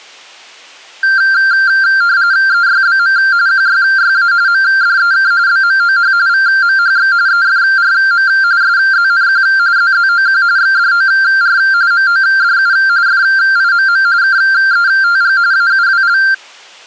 RTTY (45.45 baud, 170 Hz shift), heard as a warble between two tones, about 1480 Hz centre. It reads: EYBM QYYA MDEK BMOH VMHX EFRM SZNQ ZZOQ XDOR MODU FIMM KETG AUWL